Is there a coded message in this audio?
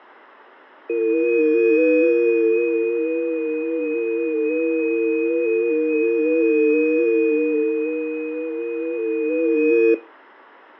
Yes: FT8 (several signals at once) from 0.9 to 9.9 s, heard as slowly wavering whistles, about 6.25 baud, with radio static and fading.